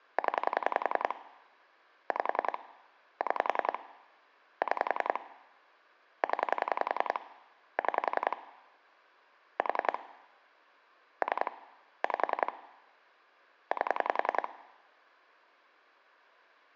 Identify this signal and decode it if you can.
Pulse dialling, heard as clicks on a phone line, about 10 pulses a second. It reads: 0 5 6 6 0 6 4 3 5 8